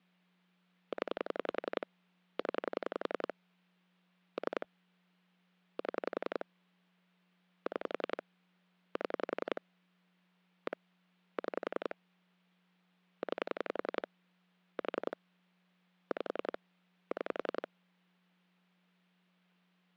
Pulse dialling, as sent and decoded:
10 / 10 / 3 / 7 / 6 / 7 / 1 / 6 / 9 / 4 / 5 / 6
0 0 3 7 6 7 1 6 9 4 5 6

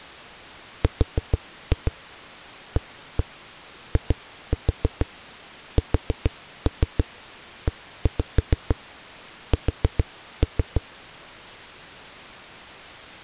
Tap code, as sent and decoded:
4-2 1-1 2-4 4-3 1-5 4-3
RAISES

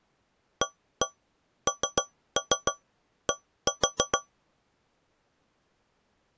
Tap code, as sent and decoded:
1-1 3-3 1-4
AND

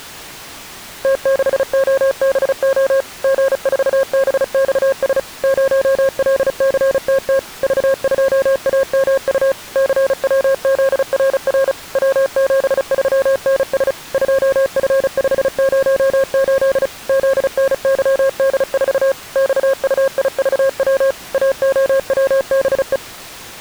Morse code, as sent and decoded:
- -.... --- -... --- / --. ....- -... -..- ... / ----- .-.. -.-. - - / ...- ..--- .- -- ..- / -.-. .-- --.. .-. .-. / .-- --... ...-- -. ... / ..--- ..-. ..... ----- ---.. / --.. -. -.-- -.. ....- / -..- ..- .. ...- .-- / .- --- .-- -... .
T6OBO G4BXS 0LCTT V2AMU CWZRR W73NS 2F508 ZNYD4 XUIVW AOWBE

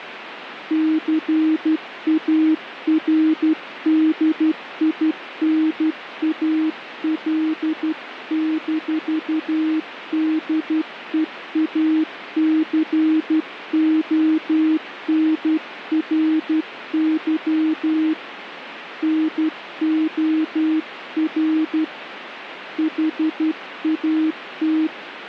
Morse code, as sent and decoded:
-.-. .- .-. -.. .. -. .- .-.. -....- -.. . .- -.-. --- -. .-. -.-- / -. --- .-. / .... .- -
CARDINAL-DEACONRY NOR HAT

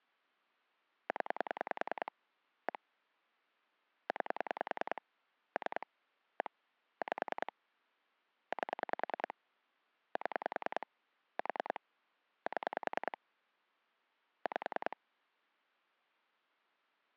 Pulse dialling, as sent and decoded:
10 / 1 / 9 / 3 / 1 / 5 / 8 / 7 / 4 / 7 / 5
0 1 9 3 1 5 8 7 4 7 5

